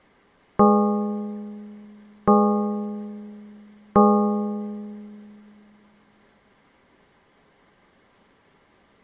Clock strike, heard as a bell. 3. Three o'clock.